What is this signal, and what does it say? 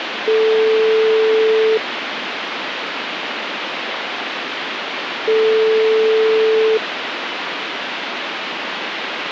Telephone call progress tone (single-tone plan, as in most of Europe), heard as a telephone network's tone, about 440 Hz, 1.5 s on and 3.5 s off, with phone line noise. Ringback tone.